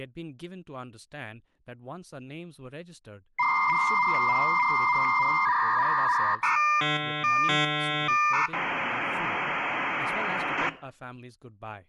Dial-up modem handshake (V.34 or later), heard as a whistle, warbles, then hiss, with room echo and speech in English.